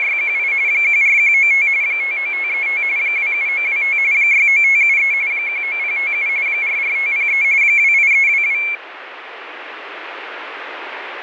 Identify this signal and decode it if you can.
RTTY (45.45 baud, 170 Hz shift), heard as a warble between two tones, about 2250 Hz centre, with radio static. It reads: … 14195 59535 27925 69573 19057 44503 28322